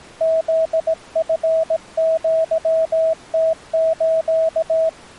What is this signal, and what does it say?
Morse code (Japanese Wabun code), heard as a keyed tone, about 17 wpm, 650 Hz. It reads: フチアムス